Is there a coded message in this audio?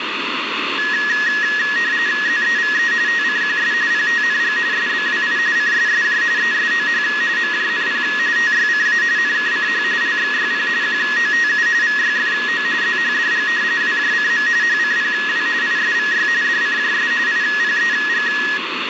Yes: RTTY (45.45 baud, 170 Hz shift) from 0.8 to 18.6 s, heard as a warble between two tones, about 1800 Hz centre, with radio static and a steady whistle near 2180 Hz. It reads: ZEVE TCQS PTNG SBWI CSSJ ESOH MJNP TYCA NKCH LXYP QOTU VYFO ZHDG WJCM HCPW ISVY DCJS IPEG